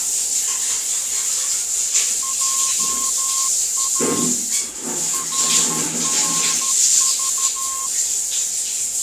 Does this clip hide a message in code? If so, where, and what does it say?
Yes: Morse code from 2.2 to 7.9 s, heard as a keyed tone, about 13 wpm, 1070 Hz, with the noise of a restroom. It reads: JA RRV